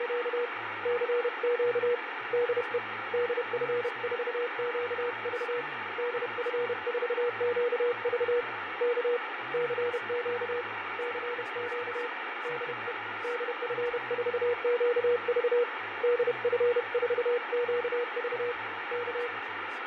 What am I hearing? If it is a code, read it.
Morse code, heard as a keyed tone, hand-sent with a paddle, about 31 wpm, 480 Hz, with heavy radio static, fading and speech in English. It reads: … CQ DE DF4QV DF4QV K CQ CQ DE DF4QV DF4QV K